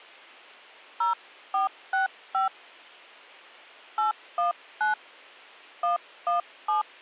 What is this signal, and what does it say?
DTMF, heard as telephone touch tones, dialled by hand, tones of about 130 ms. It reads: 0465 819 117